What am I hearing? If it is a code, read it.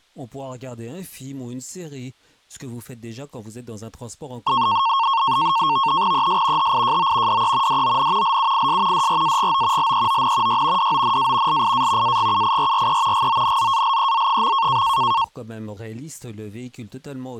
NAVTEX (SITOR-B), 100 baud, 170 Hz shift, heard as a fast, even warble, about 1000 Hz centre. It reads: ES HIJO DE DON LUIS DRAGO LEON Y DONA LIA AGUIRRE GONZALEZ.